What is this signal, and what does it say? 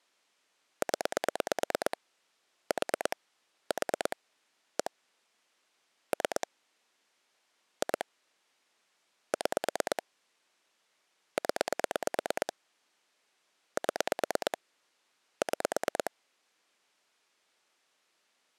Pulse dialling, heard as clicks on a phone line, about 9 pulses a second. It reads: 0 4 4 1 3 2 6 0 7 6